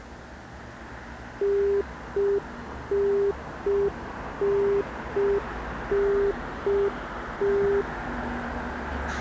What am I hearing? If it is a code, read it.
Telephone call progress tone (UK plan), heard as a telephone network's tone, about 400 Hz, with street noise. Congestion tone.